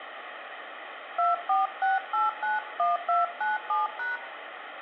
DTMF, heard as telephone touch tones, dialled by hand, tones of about 160 ms, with phone line noise and room echo. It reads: 246891297#